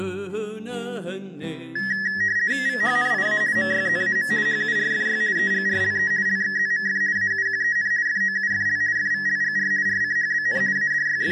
RTTY (50 baud, 170 Hz shift), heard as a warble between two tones, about 1800 Hz centre. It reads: VHNIA MYZAM HURFY EGRLE LXZMF AUQEN FOUFL FVLGR RCHBN …